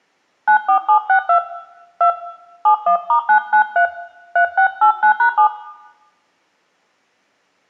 DTMF, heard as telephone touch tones, dialled by hand, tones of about 100 ms, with room echo. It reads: 94762 2 71*993 3689#7